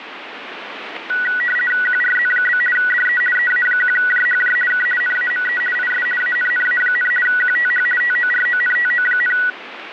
RTTY (50 baud, 450 Hz shift), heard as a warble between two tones, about 1700 Hz centre, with radio static. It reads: QRZ? DE EA1JHJ K NAME IS ANNA, QTH TORONTO,